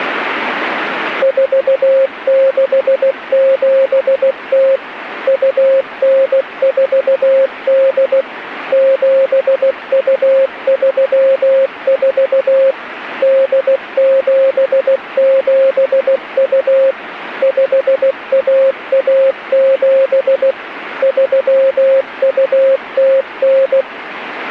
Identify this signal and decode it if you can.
Morse code (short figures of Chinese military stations), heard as a keyed tone, machine-sent, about 16 wpm, 540 Hz, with radio static. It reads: 4670 2948 7234 8772 5117 3209